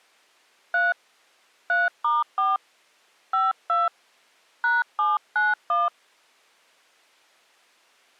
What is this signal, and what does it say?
DTMF, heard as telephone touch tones, dialled by hand, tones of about 180 ms. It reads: 3 3*4 52 #791